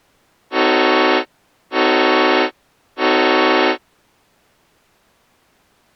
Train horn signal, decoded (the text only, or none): 3 short